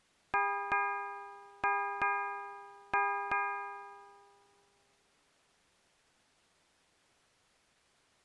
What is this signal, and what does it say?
Ship's bell, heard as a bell. 6. Six half-hours of the watch have passed.